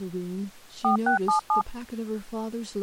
DTMF, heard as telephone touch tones, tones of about 110 ms, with speech in English. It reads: 4677